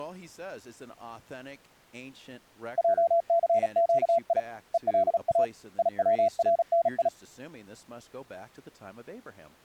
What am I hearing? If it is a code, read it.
Morse code (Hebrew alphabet), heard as a keyed tone, hand-sent with a paddle, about 36 wpm, 680 Hz, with speech in English. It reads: עסקי ולא יצרני